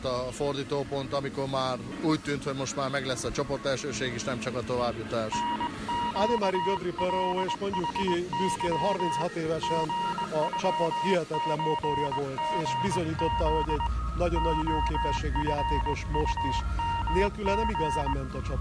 Morse code (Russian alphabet), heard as a keyed tone, hand-sent with a straight key, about 21 wpm, 940 Hz. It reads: НЩЛХЫ ГЮЧГЗ ОФУМГ